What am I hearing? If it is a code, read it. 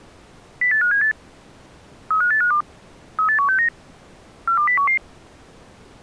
Five-tone selective call (CCIR), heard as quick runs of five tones, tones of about 100 ms. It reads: 08578 35852 38169 42011